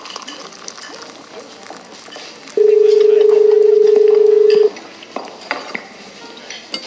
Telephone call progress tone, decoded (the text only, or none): dial tone